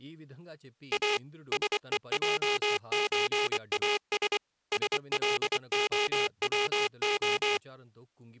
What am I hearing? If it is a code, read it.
Morse code (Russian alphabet), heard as a buzzer, machine-sent, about 24 wpm, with speech in Telugu. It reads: А СЕЙЧАС СЛОВО